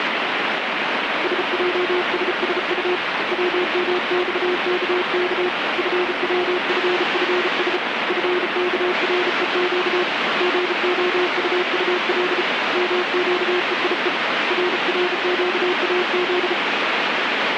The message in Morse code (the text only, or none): SJSSU WMXKK FWFFS FKREQ GOUUL MQEIE RRQAZ